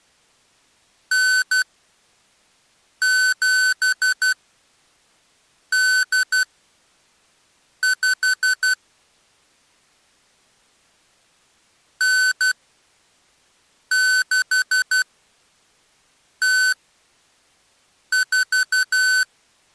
Morse code (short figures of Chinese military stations), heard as electronic beeps, machine-sent, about 12 wpm, spaced as for 5 wpm, 1500 Hz. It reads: 9785 9604